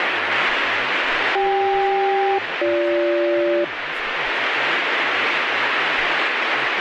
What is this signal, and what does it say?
Aircraft SELCAL, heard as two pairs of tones, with radio static and speech in Bangla. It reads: CK-BG